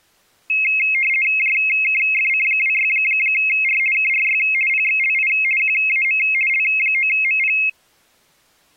RTTY (50 baud, 450 Hz shift), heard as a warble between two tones, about 2350 Hz centre. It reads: JKFC26R KRY PXLI QAM L9MP